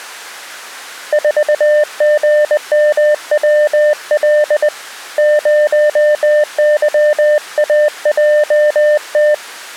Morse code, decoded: 4GMWL 0YAJT

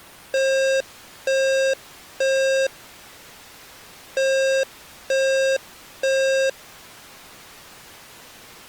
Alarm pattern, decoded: temporal three

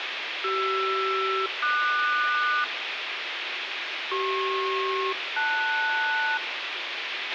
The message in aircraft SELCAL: CR-QS CP-LS

